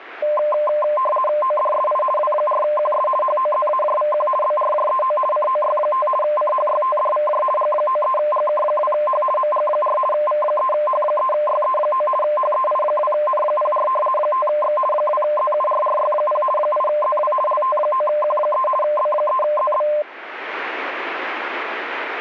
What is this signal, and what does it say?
RTTY (50 baud, 450 Hz shift), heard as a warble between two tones, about 820 Hz centre. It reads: ODSI W4QS HOZAJVQ BRJEO COY5 CHYTDVJ G93GK2H MG4 V3H3YE9 HEI2N04 5X 2ZURRY0 8ZW LT9Q3 B3ZB